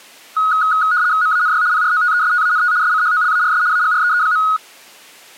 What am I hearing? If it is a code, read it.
RTTY (75 baud, 170 Hz shift), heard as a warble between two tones, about 1360 Hz centre. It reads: MANY PROTESTANT SCHOLARS AGREE.